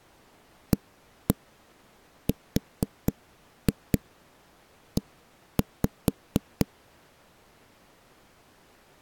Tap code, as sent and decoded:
1-1 4-2 1-5
ARE

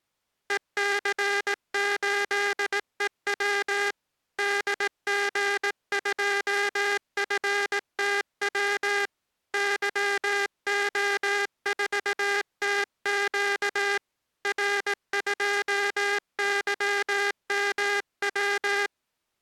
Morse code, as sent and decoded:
. -.-. ---.. . .-- / -.. --. ..--- ..-. - .-- / -.-- --- ....- - --.- / .-. ..--- -.-- -- .--
EC8EW DG2FTW YO4TQ R2YMW

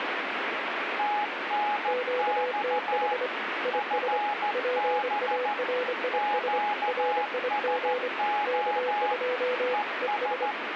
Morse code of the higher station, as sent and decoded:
- -. -..- / ..-. -... / --.- ... --- / . ...
TNX FB QSO ES

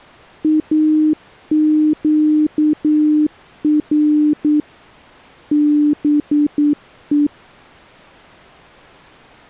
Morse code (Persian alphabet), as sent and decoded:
.- --.- .-. / -... .
اگر به

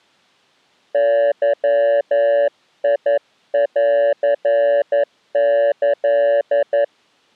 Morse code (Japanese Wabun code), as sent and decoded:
-.-- .. .-.-. -.-..
ゲンキ

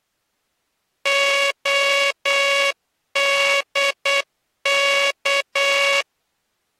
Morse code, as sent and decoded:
--- -.. -.-
ODK

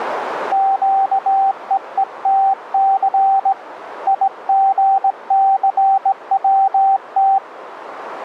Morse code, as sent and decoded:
--.- . . - -.-. / .. --. -.-. .-- -
QEETC IGCWT

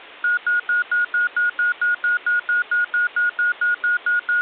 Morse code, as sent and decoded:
none

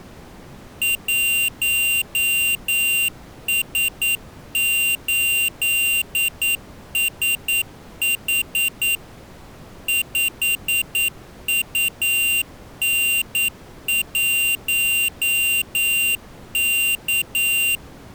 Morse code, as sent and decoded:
.---- ... ---.. ... .... / ..... ..- -. .---- -.-
1S8SH 5UN1K

